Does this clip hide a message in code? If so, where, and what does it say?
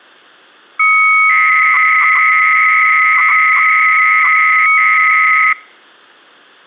Yes: 300-baud modem data (Bell 103 tones) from 0.8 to 5.5 s, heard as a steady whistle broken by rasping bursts, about 300 baud, 200 Hz shift.